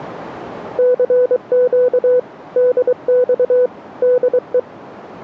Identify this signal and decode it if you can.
Morse code, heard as a keyed tone, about 23 wpm, 500 Hz. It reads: CQ DX DE